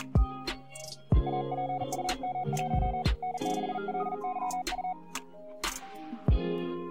Morse code, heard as a keyed tone, hand-sent with a paddle, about 40 wpm, 740 Hz. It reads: APUM1 N6LYU